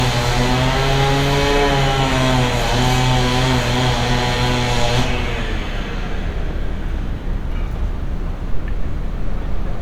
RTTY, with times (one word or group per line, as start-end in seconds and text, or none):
none